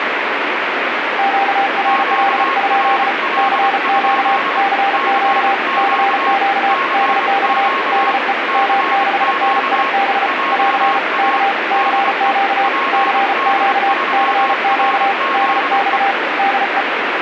Morse code, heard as two keyed tones, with radio static. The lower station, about 34 wpm, 790 Hz: QRL? CQ CQ CQ DX DE M6NIB <AR> K CQ CQ CQ DX DE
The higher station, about 25 wpm, 1090 Hz: QRL? CQ CQ CQ JA DE PD3RZE